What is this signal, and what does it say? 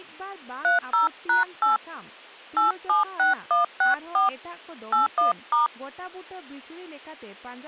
DTMF, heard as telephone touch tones, dialled by hand, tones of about 140 ms, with speech in Santali. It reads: 30#8 876164 81*